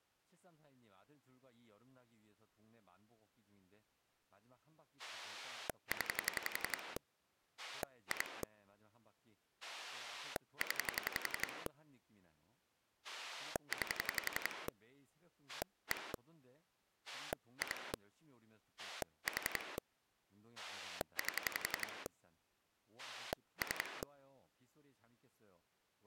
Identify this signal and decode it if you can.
Pulse dialling, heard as a rotary dial, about 11 pulses a second, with speech in Korean. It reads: 0 2 0 9 1 2 4 8 3